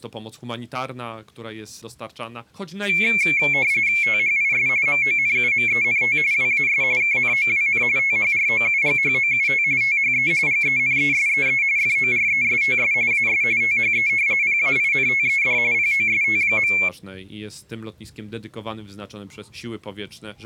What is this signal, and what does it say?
RTTY (45.45 baud, 170 Hz shift), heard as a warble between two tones, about 2250 Hz centre. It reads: THIS MONUMENT WAS KNOWN THROUGHOUT THE GENESEE FORESTS AS THE PAINTED POST.